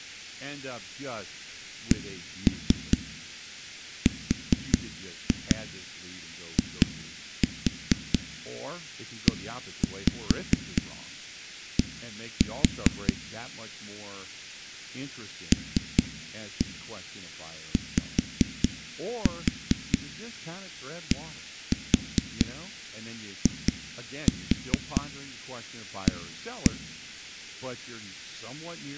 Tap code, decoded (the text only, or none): CRIED LYDIA